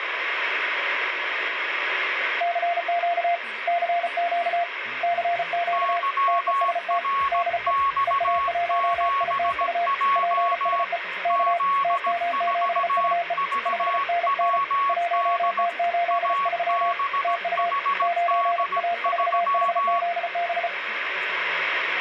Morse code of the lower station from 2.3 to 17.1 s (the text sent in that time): CQ CQ CQ TEST DE EA1ITU PSE K TM7UE 5NN 1T83